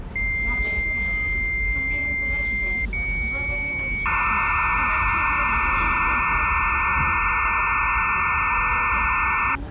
Dial-up modem handshake (low-speed, two carriers), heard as two whistles, then hiss, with the noise inside a subway train.